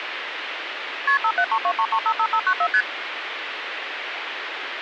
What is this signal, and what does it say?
Multi-frequency trunk signalling (R1, as on North American trunks), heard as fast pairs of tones, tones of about 70 ms, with phone line noise. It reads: KP 57323355594 ST